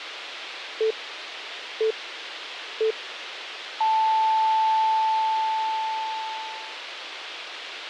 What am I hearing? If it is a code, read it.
Radio time signal (three low pips and a long one an octave up, as on NHK), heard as pips, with radio hiss and a squelch burst at the end.